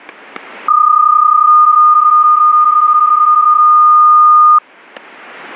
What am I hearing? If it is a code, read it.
PSK31 (31.25 baud), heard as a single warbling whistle, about 1220 Hz, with static crashes.